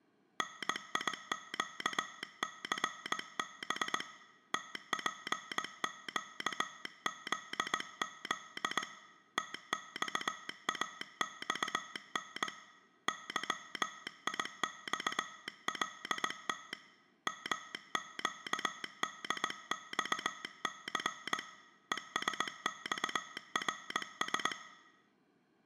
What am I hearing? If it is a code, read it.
Morse code (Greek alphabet), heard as a telegraph sounder, hand-sent with a straight key, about 19 wpm, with room echo. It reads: ΝΙΨΘΒ ΤΠΨΖΖ ΤΞΑΞΝ ΥΙΞΛΤ ΜΨΔΞΘ ΕΣΞΡΣ